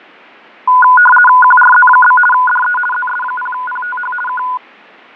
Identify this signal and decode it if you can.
RTTY (50 baud, 450 Hz shift), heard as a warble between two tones, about 1230 Hz centre, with fading. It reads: QRZ? DE ZS0PTH K